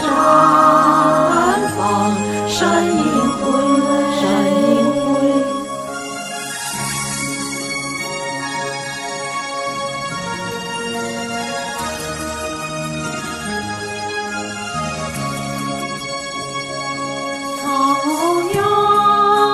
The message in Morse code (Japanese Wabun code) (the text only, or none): none